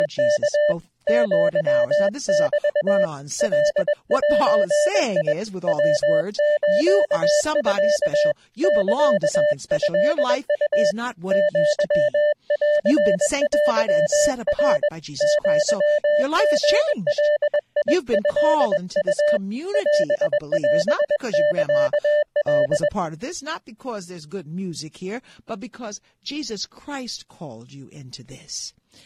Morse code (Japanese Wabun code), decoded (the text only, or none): … アメ カゼ ヤスミ サトウ アンテナ アリガトウ オオサカ